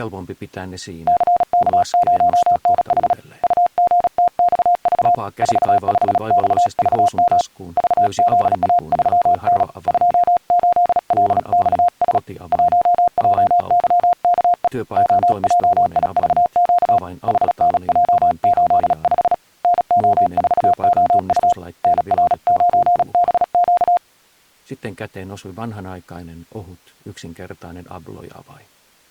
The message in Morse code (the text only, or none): CK0NH UGTXV 45XVM VZA3N 28LXS 1JYKE OJIVQ HNJ85 NO4OU NR9BQ